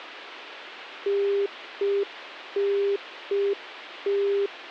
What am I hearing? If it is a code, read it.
Telephone call progress tone (UK plan), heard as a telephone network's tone, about 400 Hz. Congestion tone.